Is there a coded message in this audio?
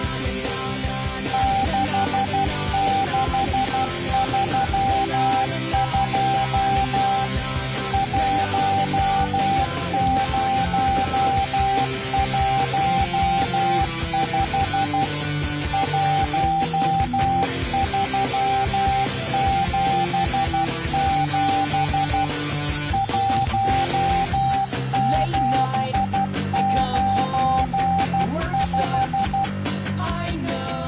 Yes: Morse code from 1.3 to 29.5 s, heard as a keyed tone, machine-sent, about 12 wpm, 780 Hz. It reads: 6632 1015 1377 1795